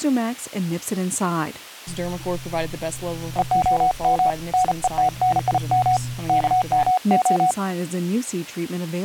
Morse code (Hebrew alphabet), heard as a keyed tone, hand-sent with a paddle, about 35 wpm, 740 Hz. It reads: והם נותנים כמה